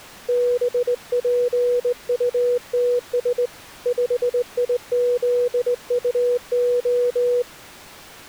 Morse code, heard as a keyed tone, hand-sent with a straight key, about 20 wpm, 490 Hz. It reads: BPUTS 5IZUO